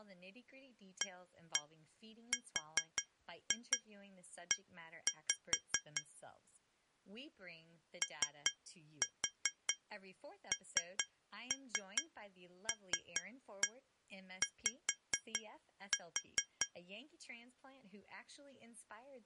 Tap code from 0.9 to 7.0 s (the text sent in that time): ARE